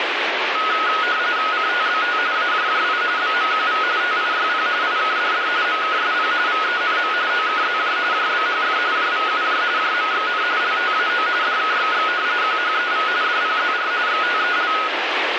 RTTY (45.45 baud, 170 Hz shift), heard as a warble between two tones, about 1360 Hz centre, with radio static. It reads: CTBT AJJI BMQV TIYP IKDD MKSP VENM OKZJ JBHF JVUJ JMXN LTAO DKXX QHEV DPZR XTEL